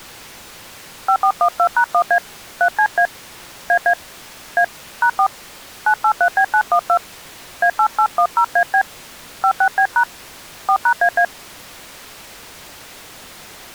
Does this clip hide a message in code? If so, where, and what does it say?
Yes: DTMF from 1.1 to 11.2 s, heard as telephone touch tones, dialled by hand, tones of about 80 ms. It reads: 5412#1A 3CA AA A #4 983B912 A8810AB 56B# 4#AA